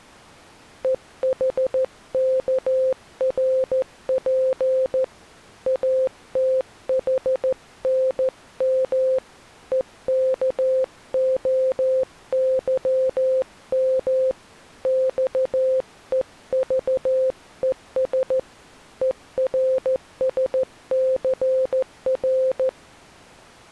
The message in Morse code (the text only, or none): EHKRP ATHNM EKOYM XEVES ERSCR